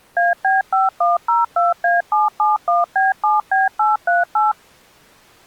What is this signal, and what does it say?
DTMF, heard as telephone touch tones, dialled by machine, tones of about 170 ms. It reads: AB5102A771B7B838